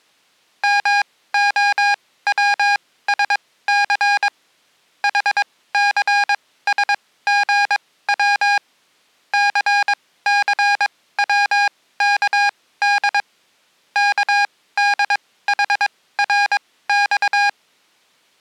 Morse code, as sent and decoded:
-- --- .-- ... -.-. / .... -.-. ... --. .-- / -.-. -.-. .-- -.- -.. / -.- -.. .... .-. -..-
MOWSC HCSGW CCWKD KDHRX

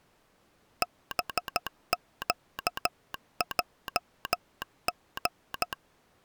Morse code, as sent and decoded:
-... --.- .--- --.
BQJG

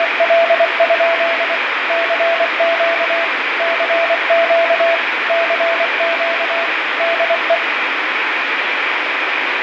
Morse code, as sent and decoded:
… / -.-. --.- / -.-. --.- / -.-. --.- / -.. .
… CQ CQ CQ DE

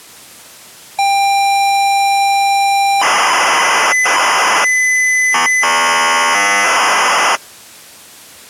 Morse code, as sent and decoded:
none

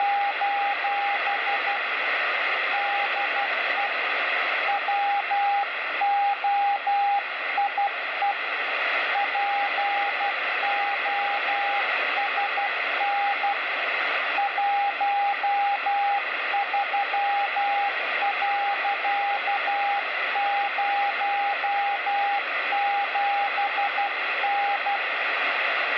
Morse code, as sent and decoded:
… / -.. . / .-- --- .. . / .--. --- ... -. / .---- ...-- .-.-.- ----- --... -.
… DE WOIE POSN 13.07N

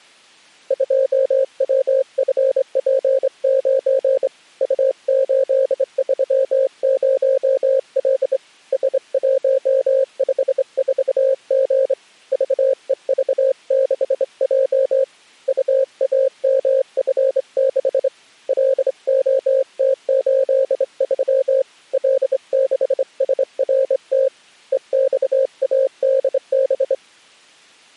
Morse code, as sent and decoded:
..--- .-- ..-. .--. ----. / ..- ---.. ...-- ----- .-.. / ... .---- ..... ....- --. / ...- . ...- -.... .--- / ..- .- -- ..-. -.... / .-.. --- - ---.. ...-- / .-.. -.... ... .-. - / . -..- .- -.. -...
2WFP9 U830L S154G VEV6J UAMF6 LOT83 L6SRT EXADB

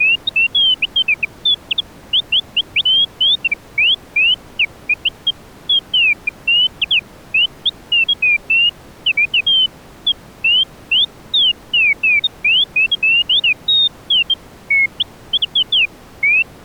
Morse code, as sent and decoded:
none

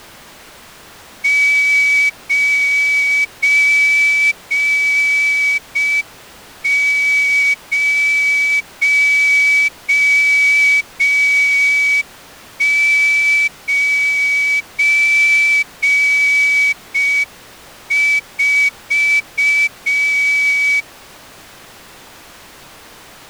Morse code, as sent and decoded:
----. ----- ----. ....-
9094

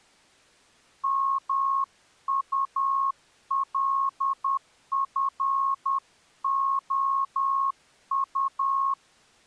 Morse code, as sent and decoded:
-- ..- .-.. ..-. --- ..-
MULFOU

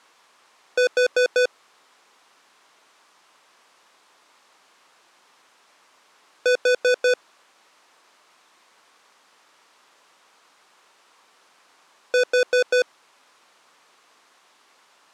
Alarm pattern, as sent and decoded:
4 beeps and a pause
temporal four

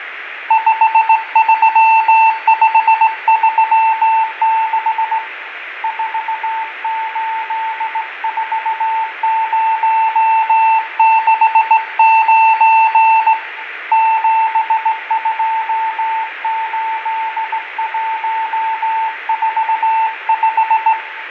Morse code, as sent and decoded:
..... ...-- ..... ...-- -.... / ....- ---.. ....- ----- -.... ----. / --... ..--- ---.. .---- ....- .....
53536 484069 728145

